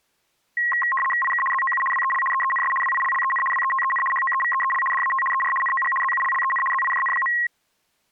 RTTY (75 baud, 850 Hz shift), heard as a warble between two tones, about 1490 Hz centre. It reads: IK ZOU WEL EENS WILLEN WETEN HOEVEEL DAT ER NOG ZULLEN ZIJN.